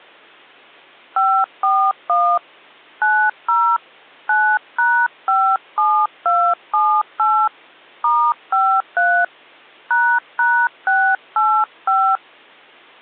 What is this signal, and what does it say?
DTMF, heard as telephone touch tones, dialled by hand, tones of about 280 ms. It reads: 541 90 9#57278 *53 ##685